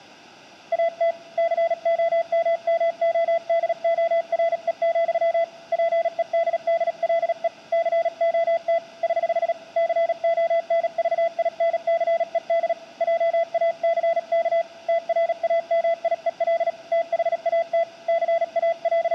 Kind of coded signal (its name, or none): Morse code